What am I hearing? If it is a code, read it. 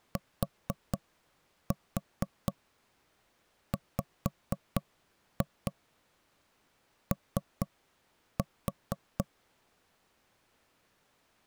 Tap code, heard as knocks on wood, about 4 knocks a second. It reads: TWO